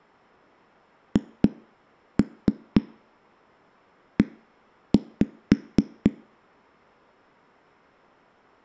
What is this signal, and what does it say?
Tap code, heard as knocks on a wall, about 4 knocks a second. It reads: HE